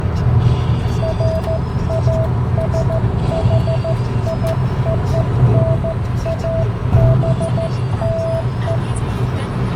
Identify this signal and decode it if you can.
Morse code (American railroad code), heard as a keyed tone, hand-sent with a straight key, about 650 Hz, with the noise inside a car. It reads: FASHIONABLE